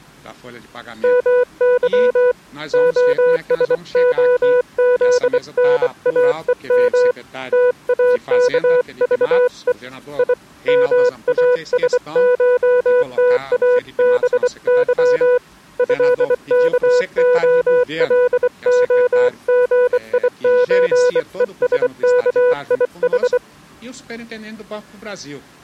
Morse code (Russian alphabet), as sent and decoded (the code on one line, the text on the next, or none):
-- -.-- / --- ... --- --.. -. .- . -- / - .- -.- ...- . / .. / -- .- ... ---- - .- -... -.-- / ..-.. -.- --- .-.. --- --. .. ---. . ... -.- .. ....
МЫ ОСОЗНАЕМ ТАКЖЕ И МАСШТАБЫ ЭКОЛОГИЧЕСКИХ